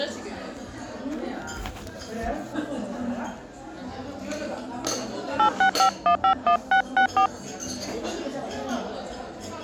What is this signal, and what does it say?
DTMF, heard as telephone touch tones, dialled by hand, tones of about 90 ms, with the noise of a restaurant. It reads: 865151664